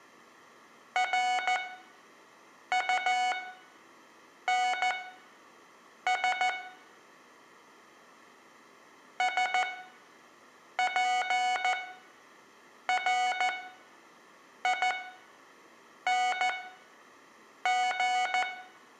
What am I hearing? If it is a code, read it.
Morse code, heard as electronic beeps, machine-sent, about 14 wpm, spaced as for 6 wpm, 740 Hz, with room echo. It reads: RUNS SPRING